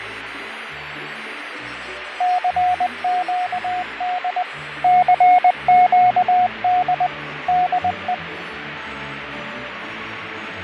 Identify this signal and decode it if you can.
Morse code, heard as a keyed tone, machine-sent, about 20 wpm, 720 Hz, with radio static and fading. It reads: CQD CQD DE